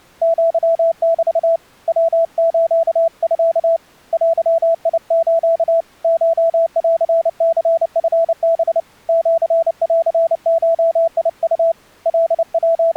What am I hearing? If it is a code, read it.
Morse code (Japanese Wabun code), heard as a keyed tone, hand-sent with a paddle, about 29 wpm, 660 Hz. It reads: アメ ヤスミ デス コンニチハ シンゴウ …